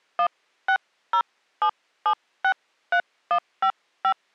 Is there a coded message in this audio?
Yes: DTMF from 0.2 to 4.1 s, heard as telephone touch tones, dialled by hand, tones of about 80 ms. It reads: 1607763155